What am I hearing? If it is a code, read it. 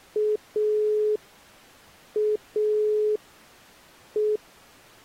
Telephone call progress tone (pulsed, as in Italy), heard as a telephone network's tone, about 420 Hz. Dial tone.